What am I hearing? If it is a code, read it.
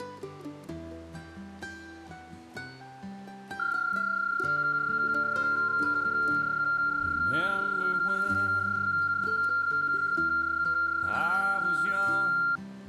PSK31 (31.25 baud), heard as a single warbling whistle, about 1390 Hz.